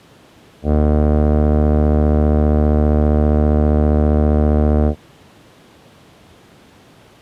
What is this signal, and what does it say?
Ship horn signal, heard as a ship's horn, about 80 Hz. 1 long. At sea: a vessel nearing a blind bend, or under power and making way in fog.